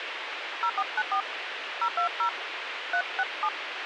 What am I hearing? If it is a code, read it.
DTMF, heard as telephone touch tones, dialled by hand, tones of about 80 ms, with radio hiss. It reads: 0494 020 367